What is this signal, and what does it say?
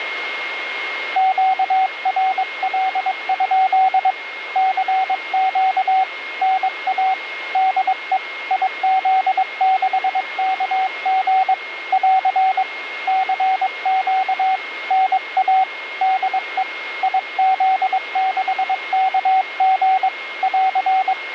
Morse code, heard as a keyed tone, hand-sent with a paddle, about 22 wpm, 760 Hz, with radio static and a steady whistle near 2150 Hz. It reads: QRL? CQ NA DE IZ6KG <AR> CQ NA DE IZ6KG <AR>